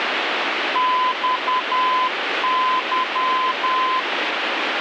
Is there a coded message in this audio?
Yes: Morse code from 0.7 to 4.1 s, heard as a keyed tone, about 10 wpm, 1020 Hz, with heavy radio static. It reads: XY